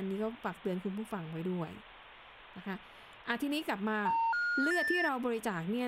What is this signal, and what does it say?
Telephone call progress tone (North American plan), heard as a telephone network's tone, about 910, 1430, 1800 Hz, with speech in Thai. Special information tone.